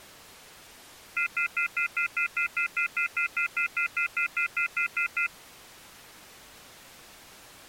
Telephone call progress tone (North American plan), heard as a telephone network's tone, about 1400, 2050, 2450, 2600 Hz, 0.1 s on and 0.1 s off. Off-hook warning tone.